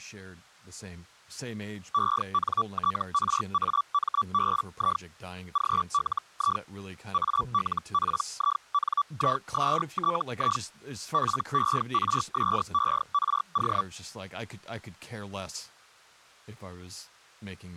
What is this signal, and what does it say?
Hellschreiber (Feld-Hell, 122.5 baud), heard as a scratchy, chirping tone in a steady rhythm, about 1150 Hz, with speech in English. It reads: ENTRAMBI GLI ALPINISTI PERSERO